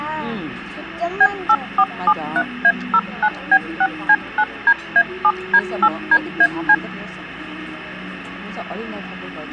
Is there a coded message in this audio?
Yes: DTMF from 1.2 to 6.7 s, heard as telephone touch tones, dialled by machine, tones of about 60 ms, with the noise of a restaurant. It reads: B8473A09B6C9DA7D8DAC